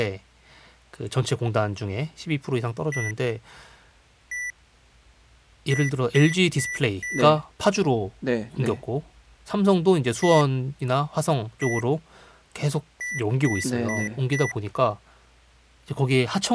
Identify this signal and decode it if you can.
Beep code, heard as beeps from a small speaker, played twice, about 1950 Hz, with speech in Korean. 1-1-4. In Phoenix BIOS tables: BIOS ROM checksum failure.